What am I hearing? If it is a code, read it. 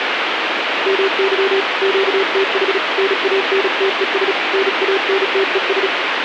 Morse code, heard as a keyed tone, hand-sent with a paddle, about 36 wpm, 390 Hz, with radio static. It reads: MY QTH NANTES NANTES